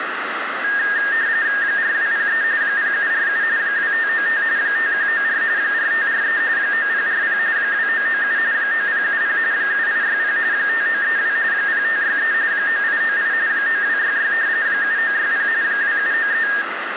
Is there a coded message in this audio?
Yes: RTTY (45.45 baud, 170 Hz shift) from 0.6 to 16.6 s, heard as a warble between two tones, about 1750 Hz centre, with radio static and room echo. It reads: 4203 0747 2595 5194 4543 9040 2997 9070 7860 5932 0563 9898 9266 7960 2793